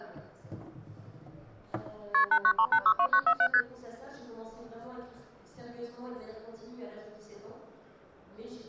Multi-frequency trunk signalling (R1, as on North American trunks), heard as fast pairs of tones, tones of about 70 ms. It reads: KP 893862947 ST